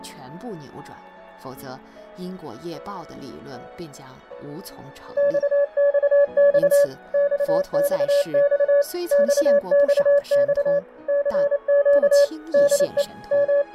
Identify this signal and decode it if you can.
Morse code, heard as a keyed tone, machine-sent, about 28 wpm, 570 Hz. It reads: XXX XXX XXX CQ DE …